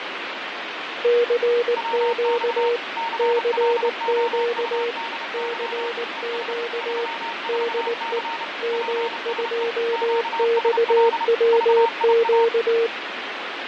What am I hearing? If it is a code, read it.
Morse code, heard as two keyed tones, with radio static and fading. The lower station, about 19 wpm, 470 Hz: CQ CQ CQ DE M2XWQ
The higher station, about 30 wpm, 920 Hz: WX CLOUDY ES 34C PSE QSL VIA